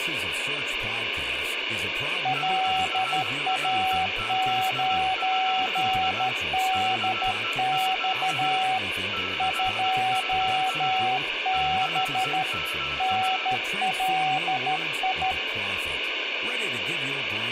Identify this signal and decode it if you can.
Morse code, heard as two keyed tones, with radio static, room echo and speech in English. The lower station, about 13 wpm, 760 Hz: LA9DX 2B NLI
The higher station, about 17 wpm, 1320 Hz: QRZ? CQ CQ CQ